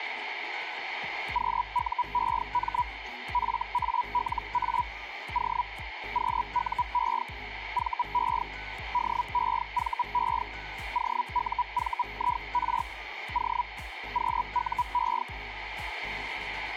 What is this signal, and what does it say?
Hellschreiber (Feld-Hell, 122.5 baud), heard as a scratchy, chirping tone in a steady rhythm, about 980 Hz, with radio static. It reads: QUEM FALA O QUE VE DEVE OUVIR O QUE